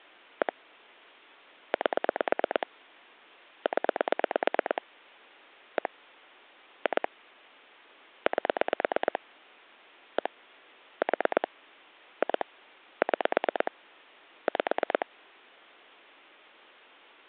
Pulse dialling, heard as clicks on a phone line, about 9 pulses a second. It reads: 1 8 0 1 2 8 1 4 2 6 5